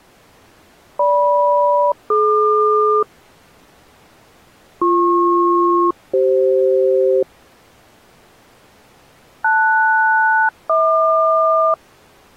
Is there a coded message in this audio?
Yes: aircraft SELCAL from 1.0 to 11.7 s, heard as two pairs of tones. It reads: GM-DQ BP-CF LS-HQ